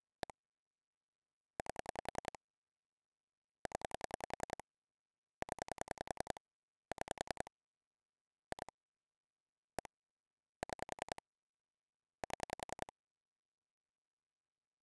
Pulse dialling, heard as clicks on a phone line, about 10 pulses a second. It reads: 1 8 0 0 6 2 1 6 7